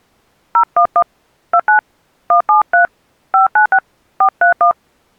DTMF, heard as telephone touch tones, dialled by hand, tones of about 90 ms. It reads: 011 29 173 596 431